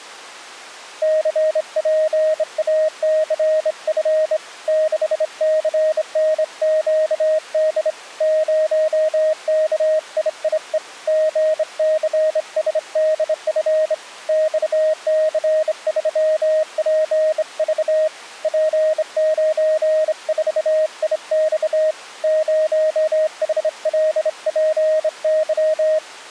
Morse code, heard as a keyed tone, hand-sent with a straight key, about 26 wpm, 620 Hz. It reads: CPACF 6CNQD 0KIIE GCSDF XC3PV P94IX 0HLPY